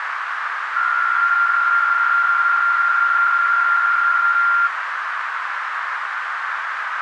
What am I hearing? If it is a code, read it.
PSK63 (62.5 baud), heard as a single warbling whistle, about 1390 Hz, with radio static and a narrow filter.